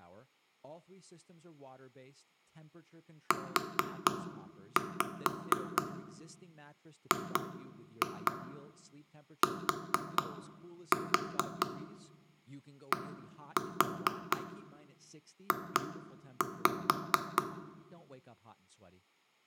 Tap code, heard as taps on a table, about 4 knocks a second, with room echo and speech in English. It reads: UGTDJ